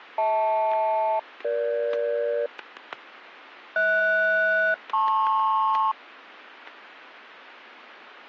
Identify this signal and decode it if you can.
Aircraft SELCAL, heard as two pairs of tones, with static crashes. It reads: HL-EG HS-LP